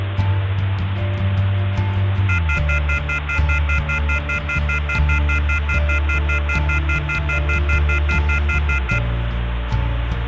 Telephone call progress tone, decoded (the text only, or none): off-hook warning tone